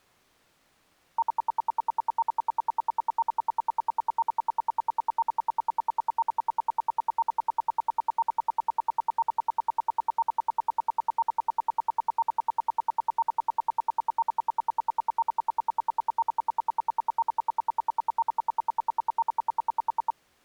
Radio time signal (RWM, Moscow), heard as ten pulses a second.